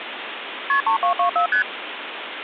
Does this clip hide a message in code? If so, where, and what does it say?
Yes: multi-frequency trunk signalling (R1, as on North American trunks) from 0.7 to 1.6 s, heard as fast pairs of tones, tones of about 100 ms, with phone line noise. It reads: KP 3224 ST